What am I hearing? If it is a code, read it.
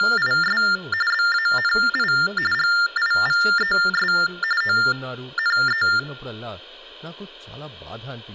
TTY/TDD text telephone tones (45.45 baud Baudot), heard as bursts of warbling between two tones, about 400 Hz shift, 1600 Hz centre, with speech in Telugu. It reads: … BANI GIVES ONE